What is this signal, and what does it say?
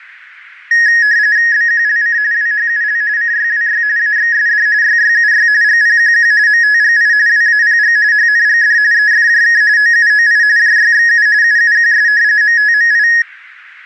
RTTY (45.45 baud, 170 Hz shift), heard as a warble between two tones, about 1800 Hz centre. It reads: BQLC WHUL CYWY AXSD YYUY GPQQ MTGI WAPG HNGD EFJK OUOI JYXU UUQS MTMI